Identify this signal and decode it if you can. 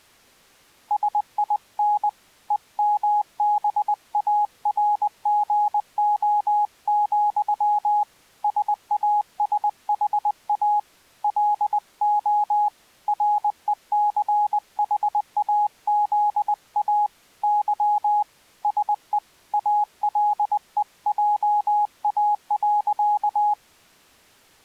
Morse code, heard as a keyed tone, hand-sent with a paddle, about 20 wpm, 830 Hz. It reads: SIN EMBARGO, SASHA LO RECHAZA Y SE ALEJA.